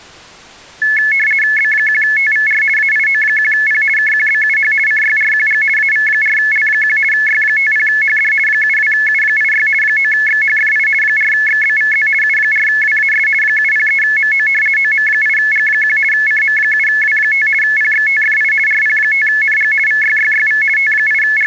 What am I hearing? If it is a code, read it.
RTTY (50 baud, 450 Hz shift), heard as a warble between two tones, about 1950 Hz centre. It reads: B1TVR AIO1P KQBUH CYRQG AV4L1 Y50HD 72U86 9XHFI 4XBVZ U4WAS 703MO OM8G1 CM7W5 PXTFI RP5NG VYYYV …